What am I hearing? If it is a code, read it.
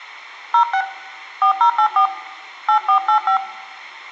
DTMF, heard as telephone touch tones, dialled by hand, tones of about 80 ms, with room echo. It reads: 06 4084 8485